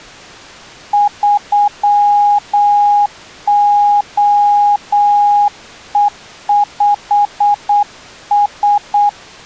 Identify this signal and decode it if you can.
Morse code, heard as a keyed tone, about 8 wpm, 820 Hz. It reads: 3OE5S